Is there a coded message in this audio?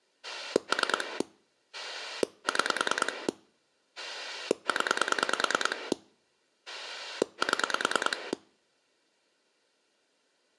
Yes: pulse dialling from 0.2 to 8.3 s, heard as a rotary dial, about 9 pulses a second. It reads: 3 6 0 7